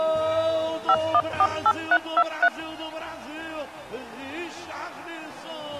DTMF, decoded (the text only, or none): 5148323